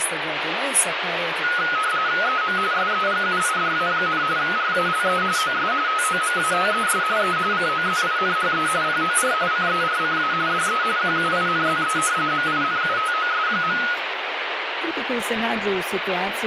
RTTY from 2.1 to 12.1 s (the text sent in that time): EM SEGUIDA, RALE OS TOMATES E COZINHE POR CERCA DE QUINZE